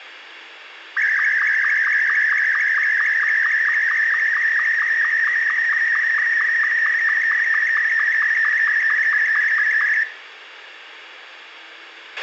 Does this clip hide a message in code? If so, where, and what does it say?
Yes: SSTV (slow-scan television), Martin M2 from 1.0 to 10.0 s, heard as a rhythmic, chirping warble, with radio hiss, a squelch burst at the end and room echo.